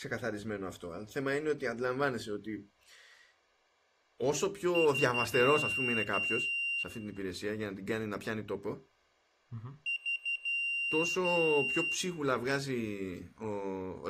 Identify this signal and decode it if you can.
Beep code, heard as a piezo beeper, played twice, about 2750 Hz, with room echo and speech in Greek. 3 short, 2 long.